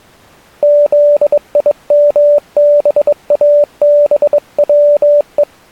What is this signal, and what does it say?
Morse code, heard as a keyed tone, hand-sent with a bug key, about 22 wpm, 590 Hz. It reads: ZIMBABWE